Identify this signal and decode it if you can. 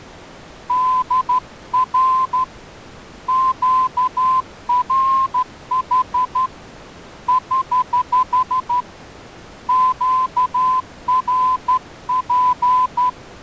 Morse code, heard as a whistle, hand-sent with a straight key, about 12 wpm. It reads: DR QRH <HH> QRP